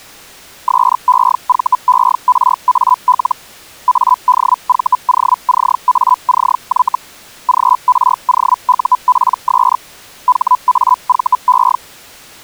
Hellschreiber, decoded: SEVERAL ADVOCACY GROUPS HAVE

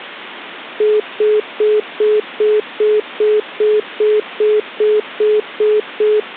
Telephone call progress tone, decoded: congestion tone

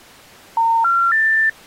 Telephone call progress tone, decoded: special information tone

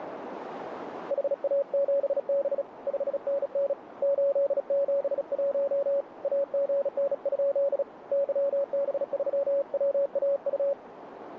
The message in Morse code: HA7B 5NN 871 AGN? YB3WAU

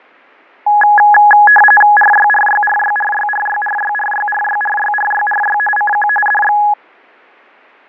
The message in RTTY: RYRYRYRYRYRYRYRYRYRYRY CQ DX

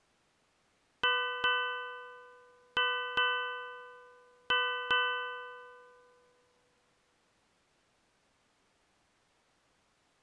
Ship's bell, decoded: 6

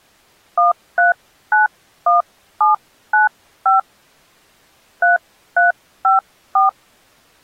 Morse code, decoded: none

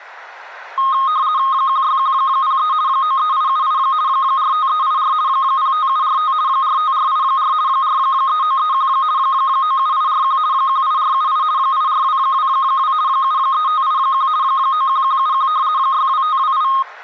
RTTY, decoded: 16103 93878 45384 05745 45484 43931 97841 18478 84222 73581 91171 62528

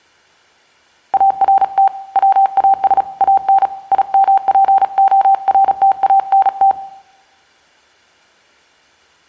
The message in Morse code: ART WAS AN IMPORTANT

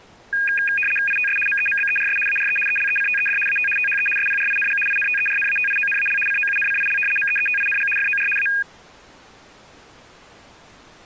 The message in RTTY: ITS MEMBERS ARE ELECTED AT THE SPRING INTERNATIONAL COUNCIL MEETING FOR A

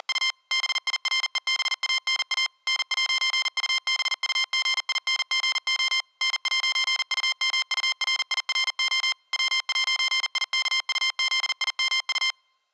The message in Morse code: … BIREBANA N'UBUGINGO N'UMURIRO W'IKUZIMU

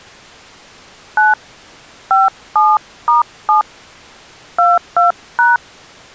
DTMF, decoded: 9 57*7 22#

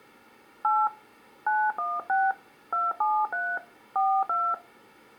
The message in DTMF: 8 916 273 42

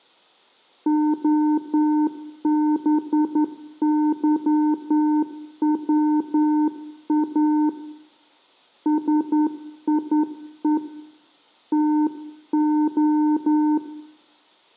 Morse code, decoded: OBYWA SIE TO

